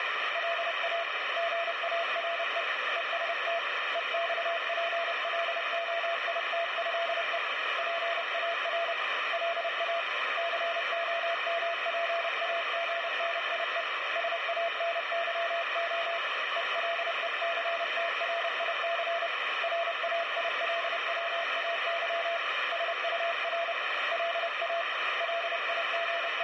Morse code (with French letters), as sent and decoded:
.-.. .- / --. .- .-. . / . ... - / . -..- .--. .-.. --- .. - ..-.. . / .--. .- .-. / .-.. .- / -.-. --- -- .--. .- --. -. .. . / ... .- -. -.-- --- / . .-.. . -.-. - .-. .. -.-. / .-. .- .. .-.. .-- .- -.-- / ... ..- .-. / .-.. .- / …
LA GARE EST EXPLOITÉE PAR LA COMPAGNIE SANYO ELECTRIC RAILWAY SUR LA …

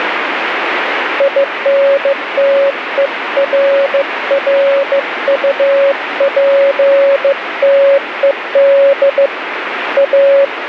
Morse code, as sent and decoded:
.. -. - . .-. .-. ..- .--. - . -.. / .-
INTERRUPTED A

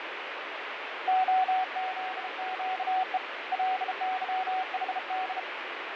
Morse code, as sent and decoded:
--- --.. --.- . / .-.. -.-- .... -..
OZQE LYHD

